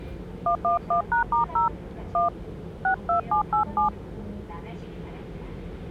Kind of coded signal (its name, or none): DTMF